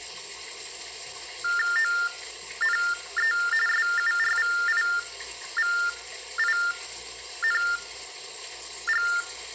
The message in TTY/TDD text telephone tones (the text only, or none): ONE SURVIVING